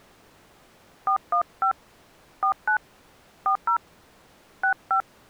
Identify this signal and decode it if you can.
DTMF, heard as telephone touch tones, dialled by hand, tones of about 90 ms. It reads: 415 49 40 65